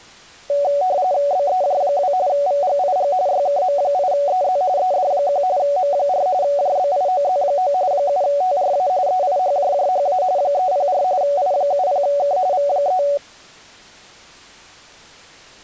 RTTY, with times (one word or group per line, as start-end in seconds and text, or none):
1.3-2.1 BEJ2
2.3-3.1 VGIG
3.3-4.6 YKM8EZ
4.8-5.4 ED1
5.6-6.3 M4
6.4-7.7 JBIOZ9
7.9-8.9 7TRA
9.1-10.2 EIHJJHA
10.4-11.0 304
11.2-12.4 I70K
12.5-13.0 V3